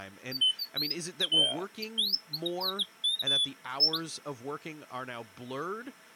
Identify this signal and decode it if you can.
Bird-like chirps, with speech in English. There is no code.